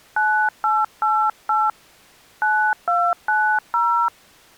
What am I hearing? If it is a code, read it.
DTMF, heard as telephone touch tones, dialled by hand, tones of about 280 ms. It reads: 9888 9290